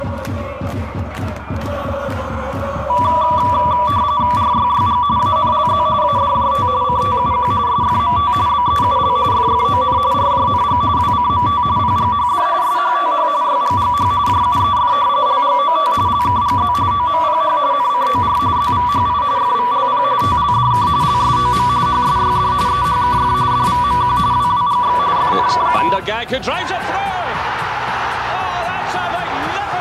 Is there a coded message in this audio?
Yes: RTTY (45.45 baud, 170 Hz shift) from 2.9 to 26.0 s, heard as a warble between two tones, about 1060 Hz centre. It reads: RYYG ANLZ ADJT CTUQ SFMT BEUL FFON RJNG WCMT PGHD SHTH YGGH JUEF LGOT LKGZ OMPH NCOR ZVHI FVLP TLDK LSOM HSYD EHKF DVMQ WWGX FNKU